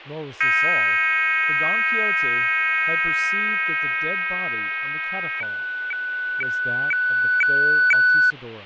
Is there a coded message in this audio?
Yes: weather fax (radiofax), 120 lines a minute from 0.4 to 8.3 s, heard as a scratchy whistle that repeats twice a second, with radio static, fading and speech in English.